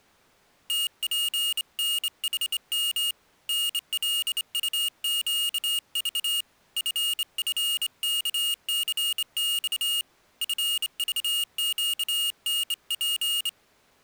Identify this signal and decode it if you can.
Morse code, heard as a high beeper, hand-sent with a straight key, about 27 wpm, 2850 Hz. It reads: TPNHM NLUQV FFKCX FVQNP